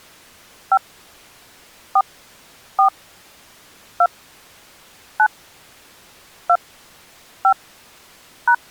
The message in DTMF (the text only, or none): 5 4 4 2 9 2 5 #